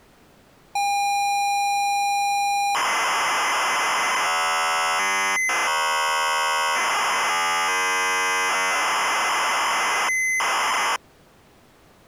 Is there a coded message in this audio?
Yes: ZX Spectrum tape loading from 0.8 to 11.0 s, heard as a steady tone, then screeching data.